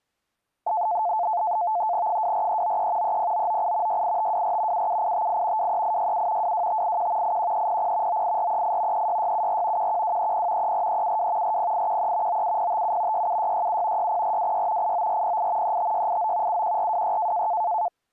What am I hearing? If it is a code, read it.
NAVTEX (SITOR-B), 100 baud, 170 Hz shift, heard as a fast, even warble, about 790 Hz centre. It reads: 24393 30998 68524 77858 23867 22581 81300 98438 36674 11230 34372 40813 97057 67667 60426 89408 35689 71426